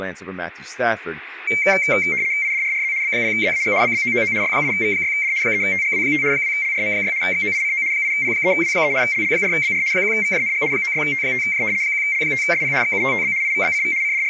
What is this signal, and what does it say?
RTTY (75 baud, 170 Hz shift), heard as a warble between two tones, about 2200 Hz centre, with room echo and speech in English. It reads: IDRRZ B0ZAG BBOOO Y8V6D 3TGW5 2LRM6 XOICO 8P3W3 LL4BR 1VJNG 96T5J 1L5SP XUTTB IVBCV …